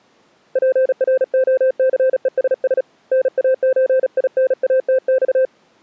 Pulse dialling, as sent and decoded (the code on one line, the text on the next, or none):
none